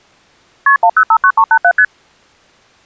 Multi-frequency trunk signalling (R1, as on North American trunks), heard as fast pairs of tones, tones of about 70 ms. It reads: KP 1059387 ST